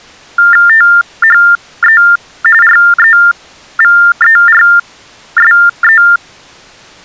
TTY/TDD text telephone tones (45.45 baud Baudot), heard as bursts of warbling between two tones, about 400 Hz shift, 1600 Hz centre. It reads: THE REVERSE